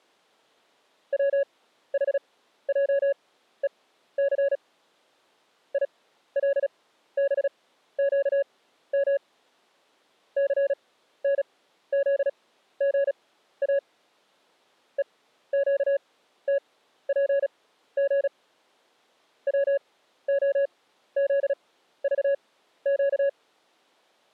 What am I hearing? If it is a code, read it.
Morse code, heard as a keyed tone, machine-sent, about 36 wpm, spaced as for 14 wpm, 560 Hz. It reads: WHJEC ILBQM CNZGA EQTPG WOZVQ